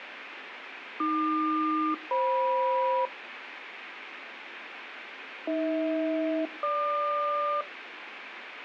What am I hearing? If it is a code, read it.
Aircraft SELCAL, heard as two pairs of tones, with radio static. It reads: AQ-FM AH-GQ